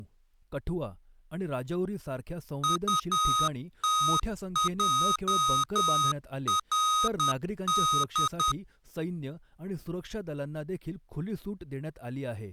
Morse code, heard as electronic beeps, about 10 wpm, 1250 Hz, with speech in Marathi. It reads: UTJRD